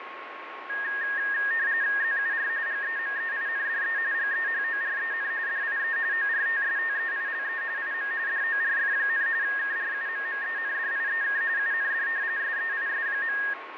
RTTY (45.45 baud, 170 Hz shift), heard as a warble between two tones, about 1750 Hz centre, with radio static and a steady whistle near 1090 Hz. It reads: ZUR GEMEINDE GEHOREN DIE ORTSTEILE IM DORF, KRUMMENDIEK UND SEIS.